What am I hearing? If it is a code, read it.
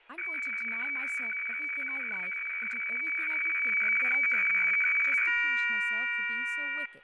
Weather fax (radiofax), 120 lines a minute, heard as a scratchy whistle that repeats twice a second, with fading and speech in English.